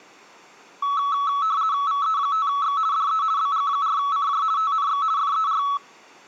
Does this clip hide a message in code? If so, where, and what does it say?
Yes: RTTY (50 baud, 170 Hz shift) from 0.8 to 5.8 s, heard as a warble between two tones, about 1210 Hz centre. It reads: VE5X DE BG4CJ TNX FER